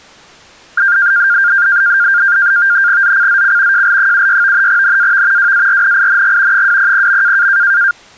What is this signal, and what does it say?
NAVTEX (SITOR-B), 100 baud, 170 Hz shift, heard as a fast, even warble, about 1500 Hz centre. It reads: ZCZC JL76 NAV WARNING 200.